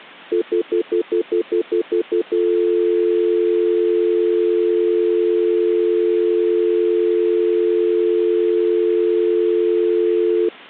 Telephone call progress tone (North American plan), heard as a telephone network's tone, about 350, 440 Hz, 0.1 s on and 0.1 s off. Stutter dial tone.